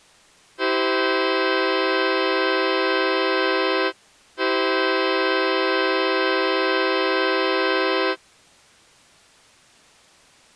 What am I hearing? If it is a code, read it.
Train horn signal, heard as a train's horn. 2 long. On North American railways: brakes released, proceed.